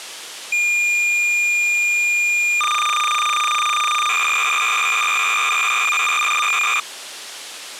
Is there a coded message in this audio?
Yes: cassette data (Kansas City type), 300 baud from 0.5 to 6.8 s, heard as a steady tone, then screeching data.